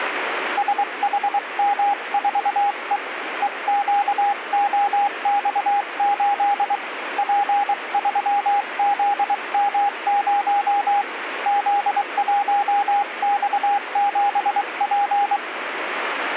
Morse code, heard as a keyed tone, hand-sent with a paddle, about 23 wpm, 810 Hz, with radio static. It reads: SHM4E EQOX8 P3ZM0 Z1X7P